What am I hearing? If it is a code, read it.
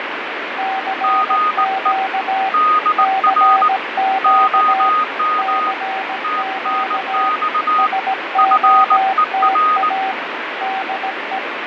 Morse code, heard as two keyed tones, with heavy radio static and fading. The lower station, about 17 wpm, 770 Hz: CQ CQ CQ SOTA DE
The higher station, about 19 wpm, 1240 Hz: GE DR OM TNX FER